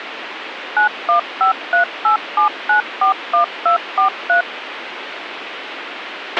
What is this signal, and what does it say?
DTMF, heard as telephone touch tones, dialled by machine, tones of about 110 ms, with radio hiss and a squelch burst at the end. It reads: 915387941243